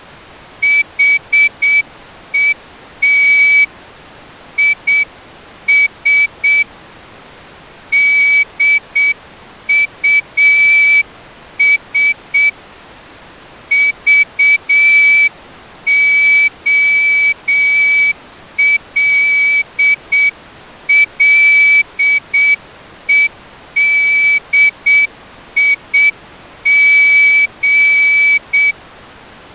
Morse code, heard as a whistle, hand-sent with a straight key, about 7 wpm. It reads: HET IS DUS VOLLEDIG